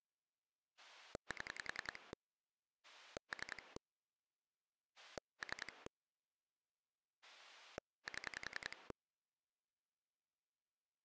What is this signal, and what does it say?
Pulse dialling, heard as a rotary dial, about 10 pulses a second. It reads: 7 3 3 7